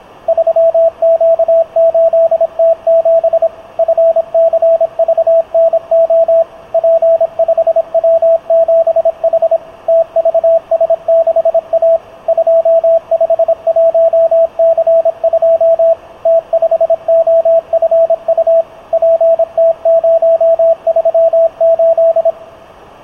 Morse code, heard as a keyed tone, machine-sent, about 26 wpm, 660 Hz. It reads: 3Q8T7 FCVNO P5W7H TVS6A 251C2 T5OFU PT038